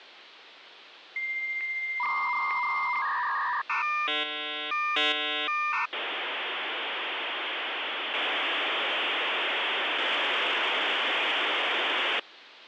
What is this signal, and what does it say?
Dial-up modem handshake (V.34 or later), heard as a whistle, warbles, then hiss, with phone line noise.